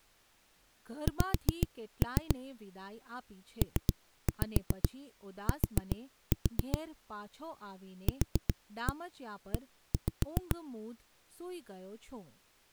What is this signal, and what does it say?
Tap code, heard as knocks on a wall, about 7 knocks a second, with speech in Gujarati. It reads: X PT QE